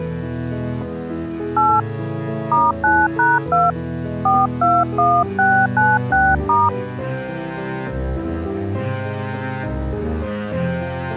DTMF, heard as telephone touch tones, dialled by hand, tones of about 230 ms. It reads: 8 *9#2 421696*